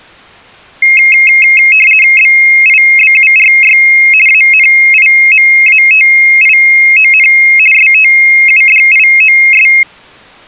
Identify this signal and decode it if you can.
RTTY (50 baud, 450 Hz shift), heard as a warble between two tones, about 2350 Hz centre. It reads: BIBURY ANIMATION STUDIOS